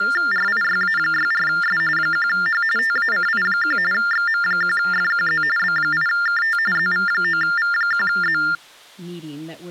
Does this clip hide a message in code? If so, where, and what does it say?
Yes: TTY/TDD text telephone tones (45.45 baud Baudot) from 0.0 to 8.6 s, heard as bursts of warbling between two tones, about 400 Hz shift, 1600 Hz centre, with speech in English. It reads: RIYA64S 1H TACI1 XM1FQZ B8KT ZV9V1Z